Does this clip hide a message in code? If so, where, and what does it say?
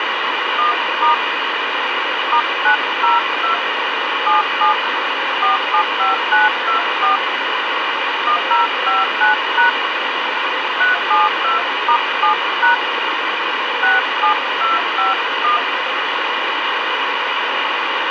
Yes: DTMF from 0.6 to 15.6 s, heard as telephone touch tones, dialled by hand, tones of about 130 ms, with radio hiss. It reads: 1* *902 77 475924 1059# 372*7# 67251